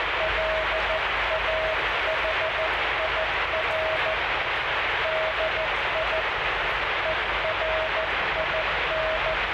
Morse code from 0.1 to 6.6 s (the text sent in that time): LAHIR DI